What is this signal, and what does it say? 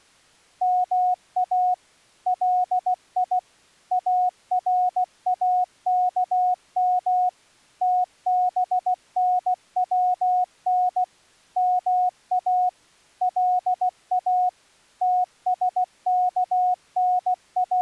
Morse code (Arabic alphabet), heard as a keyed tone, machine-sent, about 16 wpm, 730 Hz. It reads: ما لي اراكم تبنون ما لا …